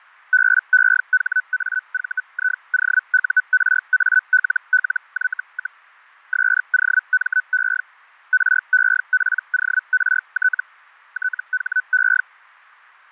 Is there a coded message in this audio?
Yes: Hellschreiber (Feld-Hell, 122.5 baud) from 0.3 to 12.2 s, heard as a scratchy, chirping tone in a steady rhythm, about 1500 Hz, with fading. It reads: BEHAVIOURALLY, SOME REPORT THE